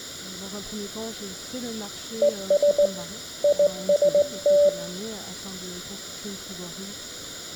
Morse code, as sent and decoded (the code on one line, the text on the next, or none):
. ... / .. ... -
ES IST